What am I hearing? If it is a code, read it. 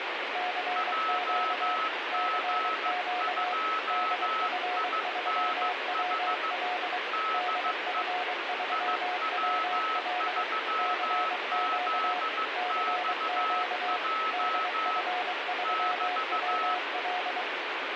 Morse code, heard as two keyed tones, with heavy radio static. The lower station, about 23 wpm, 720 Hz: CQ CQ DF3WL DF3WL CQ CQ DF3WL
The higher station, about 15 wpm, 1300 Hz: JG2INH DE IW3ZXJ <BT>